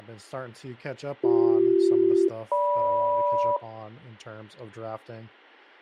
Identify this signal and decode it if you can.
Aircraft SELCAL, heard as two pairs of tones, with speech in English. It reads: BC-GM